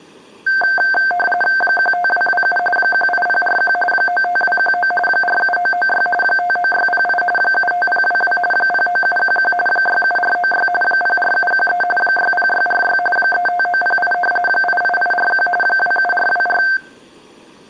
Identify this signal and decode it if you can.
RTTY (45.45 baud, 850 Hz shift), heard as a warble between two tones, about 1130 Hz centre. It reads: 15227 18041 95219 47996 59608 75022 09711 67496 04713 60646 35908 88841 27424